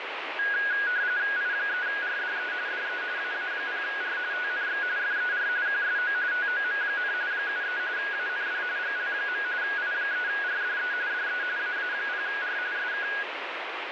RTTY (45.45 baud, 170 Hz shift), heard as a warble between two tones, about 1550 Hz centre, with radio static. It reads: I3RDE DE AA0R TNX FER QSO TOM, 73 AND GL. I3RDE DE AA0R SK